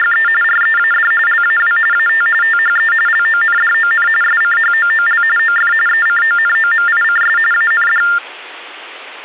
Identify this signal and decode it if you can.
TTY/TDD text telephone tones (45.45 baud Baudot), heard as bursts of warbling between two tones, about 400 Hz shift, 1600 Hz centre. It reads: … READ LAW AT THE LONDON SCHOOL OF ECONOMICS AND